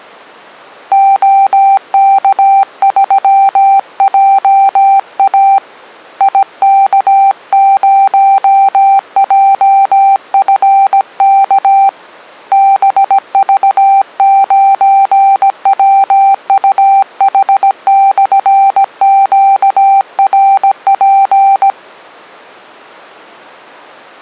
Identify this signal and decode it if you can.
Morse code, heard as a keyed tone, hand-sent with a paddle, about 17 wpm, 780 Hz. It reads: OK3JA IK0JFK BV9WUH/QRP